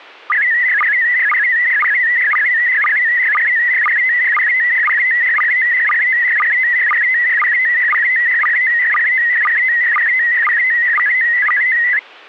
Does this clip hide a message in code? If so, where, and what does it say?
Yes: SSTV (slow-scan television), PD 120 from 0.3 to 12.0 s, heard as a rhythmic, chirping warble.